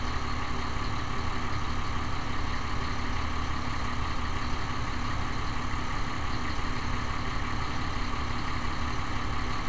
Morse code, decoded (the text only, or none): none